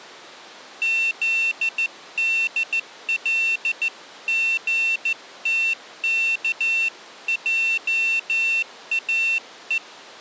Morse code (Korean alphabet), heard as a high beeper, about 14 wpm, 2700 Hz. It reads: 특성화